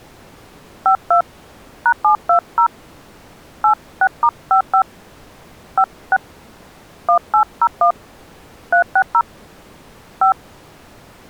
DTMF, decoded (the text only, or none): 52 #720 86*55 56 1801 360 5